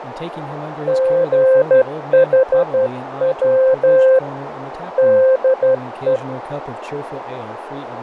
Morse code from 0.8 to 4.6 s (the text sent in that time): GHW